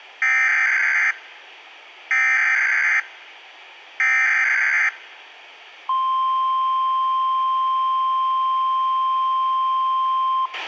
Emergency Alert System (SAME) tones (header bursts, then the 1050 Hz attention tone), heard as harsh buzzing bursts, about 520.83 baud, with a squelch burst at the end.